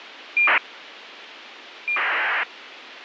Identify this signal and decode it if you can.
ACARS aircraft data, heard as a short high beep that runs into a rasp, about 2400 baud, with radio hiss.